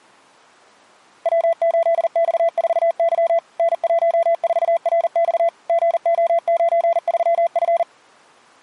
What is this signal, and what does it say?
Morse code, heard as a keyed tone, machine-sent, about 40 wpm, 670 Hz. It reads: W8X4Y N14RX GO93F